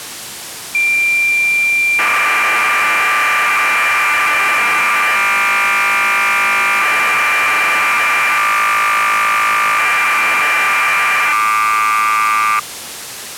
Cassette data (Kansas City type), 1200 baud, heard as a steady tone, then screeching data.